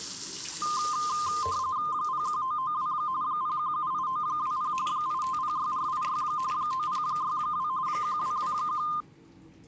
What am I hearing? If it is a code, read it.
RTTY (45.45 baud, 170 Hz shift), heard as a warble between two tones, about 1130 Hz centre, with the noise of a restroom. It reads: 01992 0178920 8506486 9062 1221